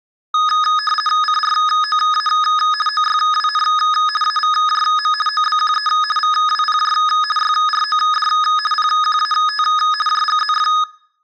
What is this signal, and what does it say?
RTTY (50 baud, 450 Hz shift), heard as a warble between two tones, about 1470 Hz centre. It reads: CROA OYWN AVJM OBQE VWPJ YROD PQAT JGZF